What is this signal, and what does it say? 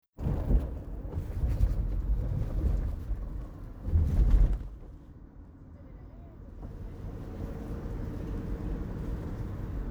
The noise inside a car. There is no code.